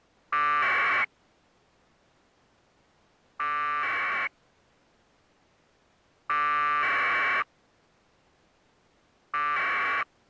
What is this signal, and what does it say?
Packet radio (AX.25, as in APRS), 1200 baud, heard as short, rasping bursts.